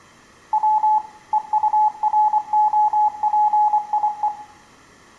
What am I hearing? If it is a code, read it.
Morse code, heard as a keyed tone, machine-sent, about 24 wpm, 850 Hz, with room echo. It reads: W EUROPIE